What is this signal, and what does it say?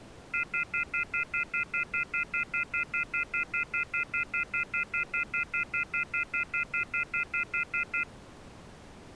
Telephone call progress tone (North American plan), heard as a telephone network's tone, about 1400, 2050, 2450, 2600 Hz, 0.1 s on and 0.1 s off. Off-hook warning tone.